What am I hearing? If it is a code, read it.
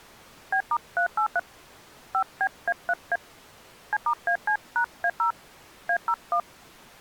DTMF, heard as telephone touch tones, dialled by hand, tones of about 70 ms. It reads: B*383 5BA3A C*AC#A0 A01